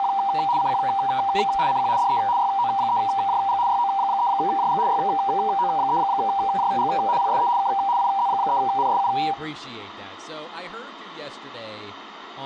RTTY (75 baud, 170 Hz shift), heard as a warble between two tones, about 870 Hz centre, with room echo. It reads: … CQ CQ DE YO3JG YO3JG YO3JG PSE K IZ3NSU